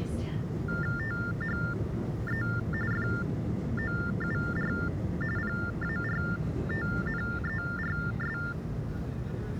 TTY/TDD text telephone tones (45.45 baud Baudot), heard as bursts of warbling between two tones, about 400 Hz shift, 1600 Hz centre, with the noise inside a subway train. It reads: THE FOUR PARTNERS